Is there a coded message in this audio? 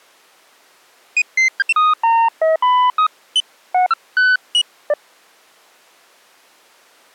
No, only electronic bleeps of random pitch and length.